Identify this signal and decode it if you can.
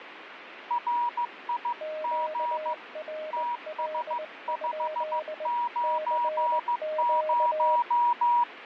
Morse code, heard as two keyed tones, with radio static. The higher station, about 15 wpm, 960 Hz: RIG TS590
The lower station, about 20 wpm, 620 Hz: QRL? CQ